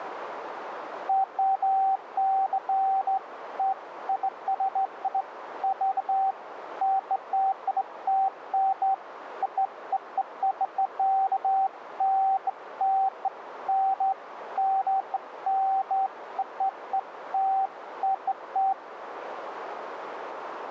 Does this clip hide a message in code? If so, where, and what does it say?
No, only beeps of irregular length, with radio static and a narrow filter.